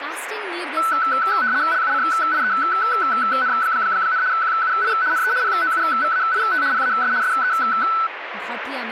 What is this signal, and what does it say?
RTTY (75 baud, 170 Hz shift), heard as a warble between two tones, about 1410 Hz centre, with radio static and speech in Nepali. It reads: LUCIEN, QUI NE POUVAIT PAS SE